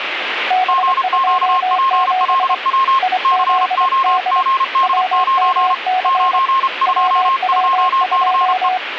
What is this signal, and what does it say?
Morse code, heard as two keyed tones, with radio static. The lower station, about 24 wpm, 740 Hz: B27 IZD WMC WW2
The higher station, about 32 wpm, 1070 Hz: GQPLW COGD9 922CE